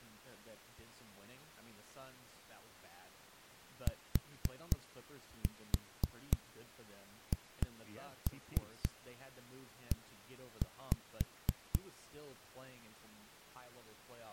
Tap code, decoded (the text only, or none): THE